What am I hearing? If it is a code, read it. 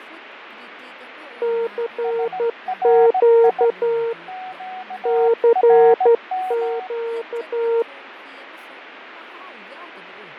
Morse code, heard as two keyed tones, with radio static, fading and speech in Manipuri. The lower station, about 12 wpm, 460 Hz: CQ CQ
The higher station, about 17 wpm, 740 Hz: SRI QRM